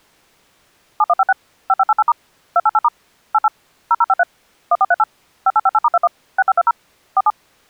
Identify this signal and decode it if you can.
DTMF, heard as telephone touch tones, dialled by machine, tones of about 40 ms. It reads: 7156 5588* 288* 88 0053 1438 5858*21 6520 47